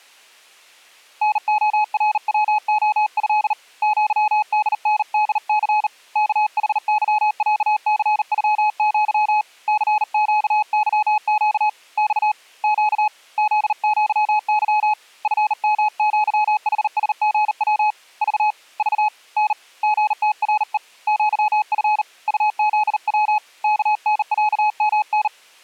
Morse code (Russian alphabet), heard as a keyed tone, hand-sent with a bug key, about 39 wpm, 850 Hz. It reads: НОРВОЭ ЪДНДЦ КХЫЯЦЮЪ ЦЩЫЩ Ь Щ ЗЪЫ ФМЪХСГВ Ж Ж Н ГТРЕ ЪФ УЗВ КНЯМН